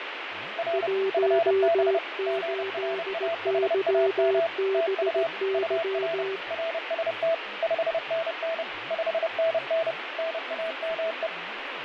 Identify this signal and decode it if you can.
Morse code, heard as two keyed tones, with radio static, fading and speech in Assamese. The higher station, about 30 wpm, 660 Hz: R FB GRAHAM TU UR RST 5NN 5NN NAME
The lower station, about 17 wpm, 390 Hz: 18YBY